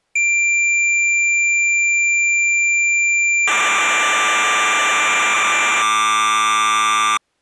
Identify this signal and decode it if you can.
Cassette data (Kansas City type), 1200 baud, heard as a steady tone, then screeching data.